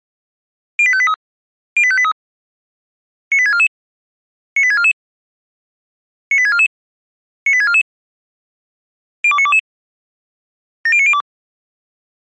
Five-tone selective call (ZVEI), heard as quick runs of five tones, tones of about 70 ms. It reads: 08583 08583 98644 98644 98644 98644 02922 70902